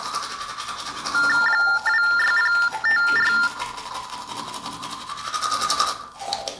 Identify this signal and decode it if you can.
TTY/TDD text telephone tones (45.45 baud Baudot), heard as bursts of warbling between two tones, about 400 Hz shift, 1600 Hz centre, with the noise of a restroom. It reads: 26054